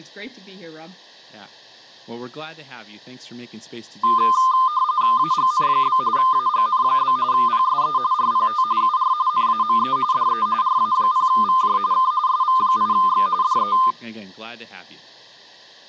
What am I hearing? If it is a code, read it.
RTTY (45.45 baud, 170 Hz shift), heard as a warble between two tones, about 1120 Hz centre, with speech in English. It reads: AGN? AGN? PSE RPT UR NAME DE RA0VJ K SV8X DE